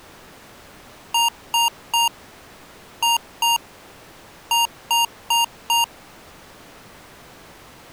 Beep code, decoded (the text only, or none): 3-2-4